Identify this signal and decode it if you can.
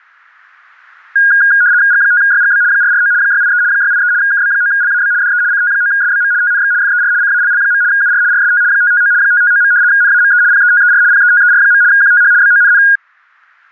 RTTY (75 baud, 170 Hz shift), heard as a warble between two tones, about 1550 Hz centre, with static crashes. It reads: G5YGB 449 683 683 KB9LAB DE CT9SBM TNX FER CALL. UR RST 559 559. NAME PETER PETER. QTH BONN